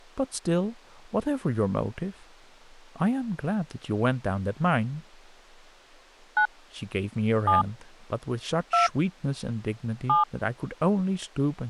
DTMF, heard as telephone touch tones, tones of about 140 ms, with speech in English. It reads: 9 7 2 7